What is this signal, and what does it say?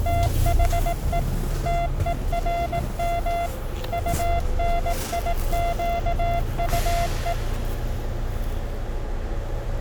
Morse code, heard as a keyed tone, machine-sent, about 18 wpm, 690 Hz, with the noise inside a bus. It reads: THE TERM UNIQUE